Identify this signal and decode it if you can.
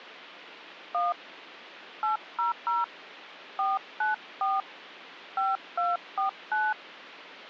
DTMF, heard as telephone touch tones, dialled by hand, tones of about 160 ms. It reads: 1 800 494 5249